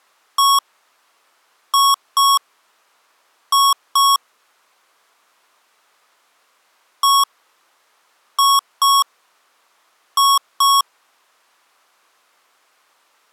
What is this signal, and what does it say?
Beep code, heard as beeps from a small speaker, played twice, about 1110 Hz. 1-2-2. In Phoenix BIOS tables: DMA initialisation failure.